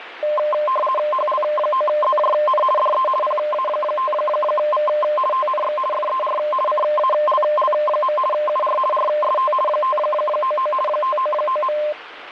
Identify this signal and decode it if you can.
RTTY (50 baud, 450 Hz shift), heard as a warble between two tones, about 830 Hz centre, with radio static. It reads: HL9ZJN DE PA5V TNX FER CALL. UR RST 599 599.